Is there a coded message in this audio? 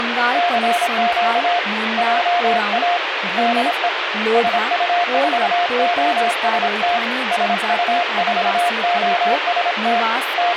Yes: Morse code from 0.3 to 10.6 s, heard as a keyed tone, hand-sent with a paddle, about 26 wpm, 700 Hz, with radio static and speech in Nepali. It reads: CQ JA DE SU4OST SU4OST …